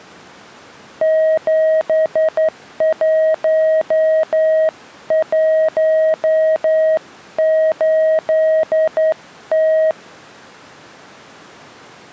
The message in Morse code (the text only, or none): 7118T